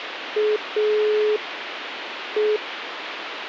Telephone call progress tone (pulsed, as in Italy), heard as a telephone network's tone, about 420 Hz, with phone line noise. Dial tone.